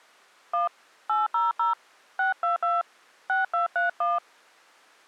DTMF, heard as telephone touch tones, dialled by hand, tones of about 150 ms. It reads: 1 800 622 6231